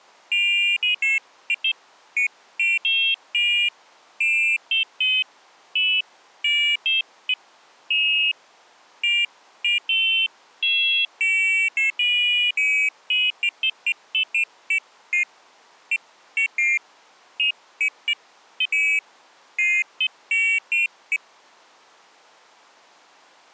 Pairs of high tones at irregular times. There is no code.